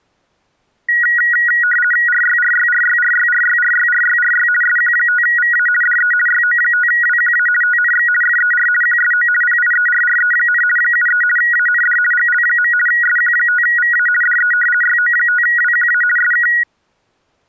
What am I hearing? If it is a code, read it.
RTTY (50 baud, 450 Hz shift), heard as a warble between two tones, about 1700 Hz centre. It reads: RYRYRYRYRYRYRYRY SQ5VA DE YO5WQA TNX FER QSO PIERRE, 73 AND GL. SQ5VA DE YO5WQA SK